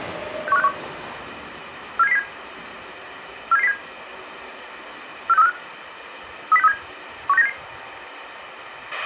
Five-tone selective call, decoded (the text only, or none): 61561 47707 47707 46345 30637 16977